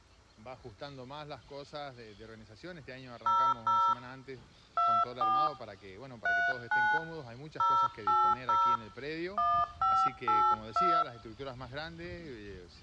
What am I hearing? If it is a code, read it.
DTMF, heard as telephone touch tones, dialled by hand, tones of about 270 ms, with room echo. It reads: 00 24 39 080 1582